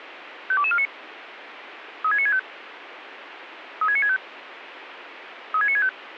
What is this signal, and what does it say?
Five-tone selective call (ZVEI), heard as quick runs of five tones, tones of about 70 ms, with radio hiss. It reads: 52249 36965 36965 36965